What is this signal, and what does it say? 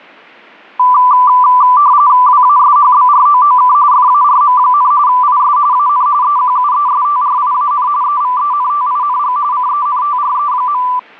RTTY (45.45 baud, 170 Hz shift), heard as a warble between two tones, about 1080 Hz centre. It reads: WASHBROOK FARM, IS AN EQUESTRIAN EVENTING CENTRE.